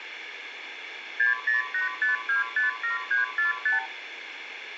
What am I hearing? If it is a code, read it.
Multi-frequency trunk signalling (R2, with the far end's replies), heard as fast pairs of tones, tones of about 140 ms, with phone line noise. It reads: 6085257345